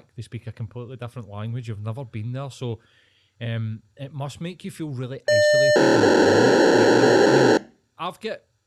POCSAG pager data (1200 baud), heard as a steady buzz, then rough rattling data, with speech in English.